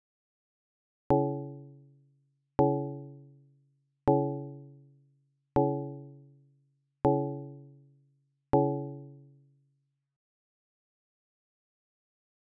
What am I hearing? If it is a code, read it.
Clock strike, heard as a bell. 6. Six o'clock.